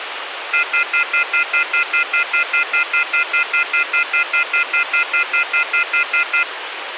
Telephone call progress tone (North American plan), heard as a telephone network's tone, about 1400, 2050, 2450, 2600 Hz, 0.1 s on and 0.1 s off, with phone line noise. Off-hook warning tone.